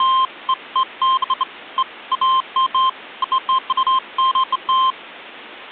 Beeps of irregular length. There is no code.